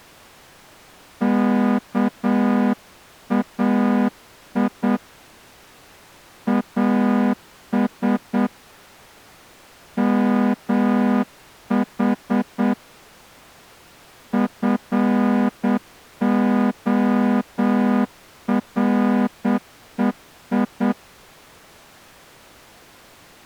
Morse code (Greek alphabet), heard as a horn, hand-sent with a straight key, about 8 wpm. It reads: ΚΑΙ ΑΣ ΜΗ ΦΟΡΕΙ